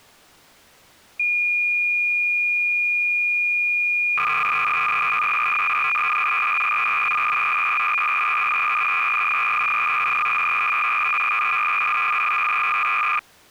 Cassette data (Kansas City type), 300 baud, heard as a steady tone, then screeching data.